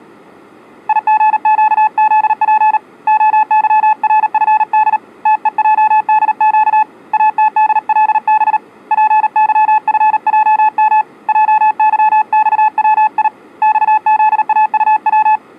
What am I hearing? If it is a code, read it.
Morse code, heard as a keyed tone, hand-sent with a paddle, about 38 wpm, 860 Hz. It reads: IGQZP OYRFD TEJDQ ATDLB PYFJM JYXWI XZAUW